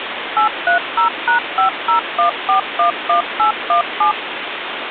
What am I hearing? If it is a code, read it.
DTMF, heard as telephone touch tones, dialled by machine, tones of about 110 ms, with phone line noise. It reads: 830#501411817